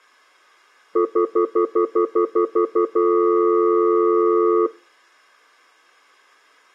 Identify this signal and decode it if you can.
Telephone call progress tone (North American plan), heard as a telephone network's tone, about 350, 440 Hz, 0.1 s on and 0.1 s off. Stutter dial tone.